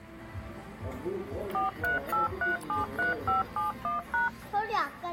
DTMF, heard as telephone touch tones, dialled by machine, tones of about 140 ms, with the noise of a restaurant. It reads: 438373571#